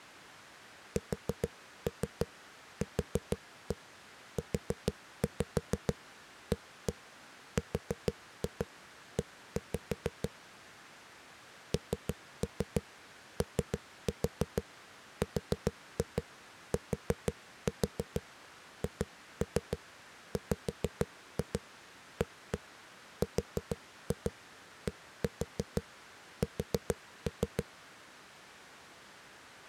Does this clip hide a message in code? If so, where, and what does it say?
Yes: tap code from 1.0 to 27.6 s, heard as knocks on a wall, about 6 knocks a second. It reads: SQUARE NORTHWARDS